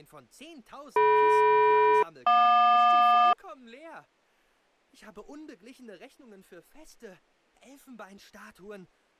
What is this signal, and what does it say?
Aircraft SELCAL, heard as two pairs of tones. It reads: DM-JQ